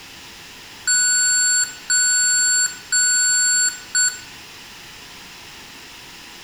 Beep code, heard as beeps from a small speaker, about 1480 Hz, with room echo. 3 long, 1 short.